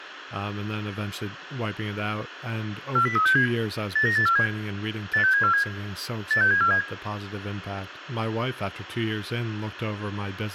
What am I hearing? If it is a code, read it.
Five-tone selective call (CCIR), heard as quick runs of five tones, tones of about 100 ms, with radio hiss and speech in English. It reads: 40367 89847 86747 86747